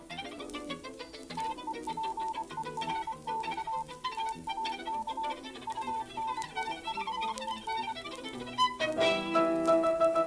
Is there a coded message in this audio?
Yes: Morse code (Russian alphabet) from 1.3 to 8.0 s, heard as a keyed tone, machine-sent, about 24 wpm, 890 Hz. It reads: ТЕПЕРЬ ТАК УНИЖЕН